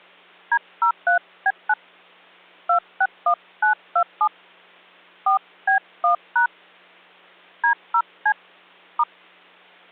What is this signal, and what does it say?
DTMF, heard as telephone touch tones, dialled by hand, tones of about 80 ms. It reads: D03B9 261927 4B1# D0C *